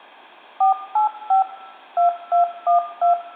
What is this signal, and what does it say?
DTMF, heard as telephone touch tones, dialled by machine, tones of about 120 ms, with room echo. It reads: 485 2212